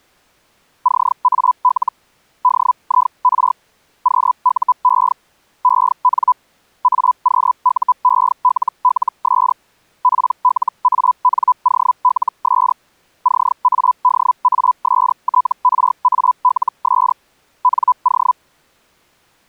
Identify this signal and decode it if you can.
Hellschreiber (Feld-Hell, 122.5 baud), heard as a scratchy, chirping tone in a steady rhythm, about 1000 Hz. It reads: CAL DIR QUE EN AQUELLS PLANOLS CADASTRALS NO